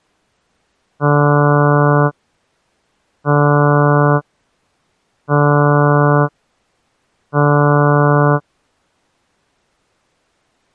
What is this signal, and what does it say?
Ship horn signal, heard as a ship's horn, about 150 Hz. 4 short. At sea: a pilot vessel's identity signal in fog.